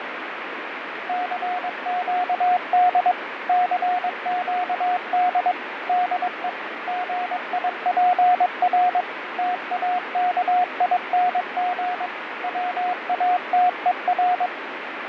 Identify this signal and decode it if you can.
Morse code, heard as a keyed tone, machine-sent, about 22 wpm, 720 Hz, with radio static and fading. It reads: CQD CQD DE GIPR TAKING WATER